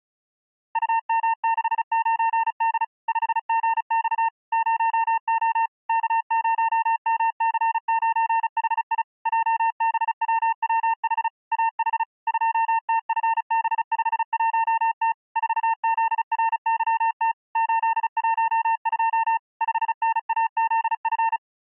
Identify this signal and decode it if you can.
Morse code, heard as a keyed tone, machine-sent, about 35 wpm, 910 Hz. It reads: UM69D 5GX 0O K0MC9HI JBWWH AH 2TFB51T 4ZRYT 812 5NAZF